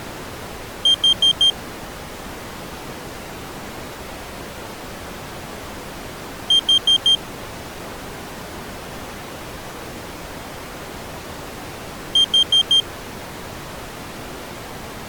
Alarm pattern, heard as an alarm's beeps, played three times, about 3200 Hz. Temporal four. Carbon monoxide.